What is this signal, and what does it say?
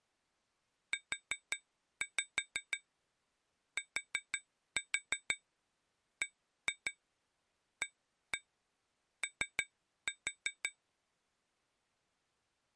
Tap code, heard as taps on glass, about 6 knocks a second. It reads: UTBAO